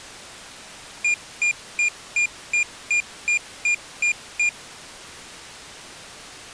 Beep code, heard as a piezo beeper, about 2400 Hz. 10 short. In AMI BIOS tables: CMOS shutdown register error.